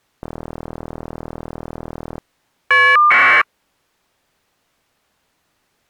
Caller ID data burst, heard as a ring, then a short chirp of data, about 1200 baud.